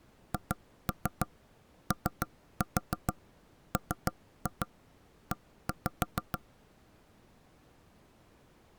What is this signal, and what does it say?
Tap code, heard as knocks on wood, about 6 knocks a second. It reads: HOME